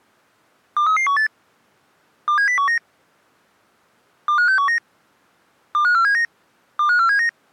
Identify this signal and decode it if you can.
Five-tone selective call (CCIR), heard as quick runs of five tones, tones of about 100 ms. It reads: 23318 27019 25619 25479 25479